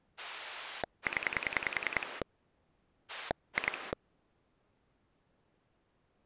Pulse dialling, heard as a rotary dial, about 10 pulses a second. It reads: 0 2